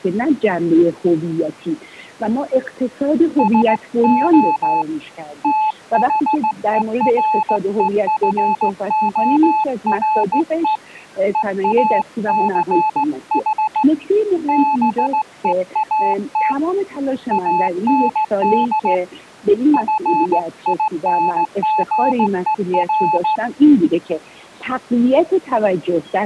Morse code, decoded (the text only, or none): SO THEREFORE EACH BEAT AND FINGER